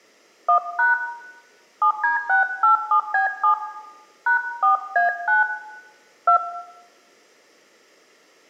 DTMF, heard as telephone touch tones, dialled by hand, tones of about 110 ms, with room echo. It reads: 1# 7D687B7 #4A9 2